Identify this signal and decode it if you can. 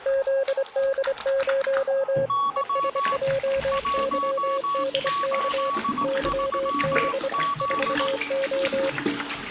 Morse code, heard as two keyed tones, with the noise of a restroom. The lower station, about 25 wpm, 540 Hz: ZD0 ESJYDK YB 4O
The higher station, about 18 wpm, 1130 Hz: Y 183Z